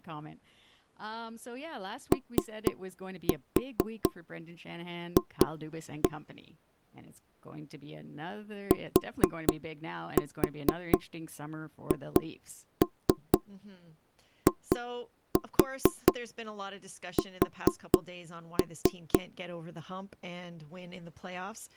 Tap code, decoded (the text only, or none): OF THIS